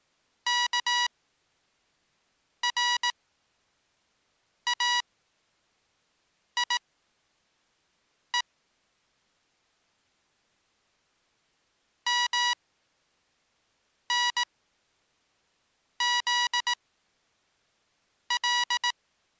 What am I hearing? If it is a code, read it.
Morse code (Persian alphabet), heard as electronic beeps, machine-sent, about 18 wpm, spaced as for 5 wpm, 970 Hz. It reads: کرایه منزل